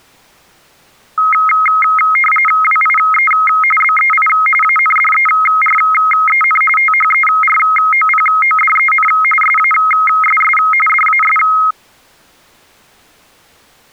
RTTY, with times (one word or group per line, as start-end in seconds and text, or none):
2.6-3.3 WIE
3.8-4.3 BEI
4.6-6.6 ANDEREN
6.8-9.1 THEROPODEN
9.4-10.6 SASS
10.9-11.4 DAS